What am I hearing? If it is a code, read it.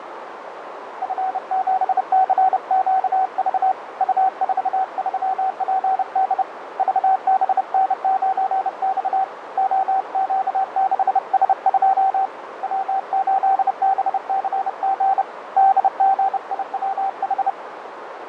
Morse code, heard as a keyed tone, hand-sent with a bug key, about 30 wpm, 770 Hz, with radio static, fading and a narrow filter. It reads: F7CQV U43PD VBN9X OQ6S2 W8BCG DGIWH